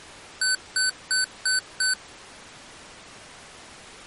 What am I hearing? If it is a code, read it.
Beep code, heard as beeps from a small speaker, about 1500 Hz. 5 short. In AMI BIOS tables: processor failure; in Dell tables: CMOS battery failure.